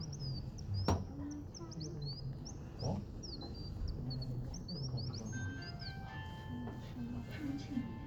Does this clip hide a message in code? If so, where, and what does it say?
No, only bird-like chirps, with the noise inside a lift.